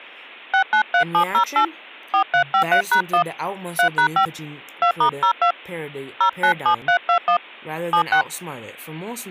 DTMF, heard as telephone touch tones, dialled by hand, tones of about 90 ms, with speech in English. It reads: 693708 4353#1 3#5 2*02 097321 76